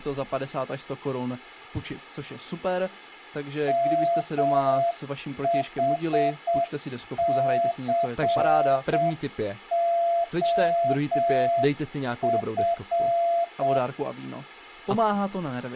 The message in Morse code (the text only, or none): MHCOF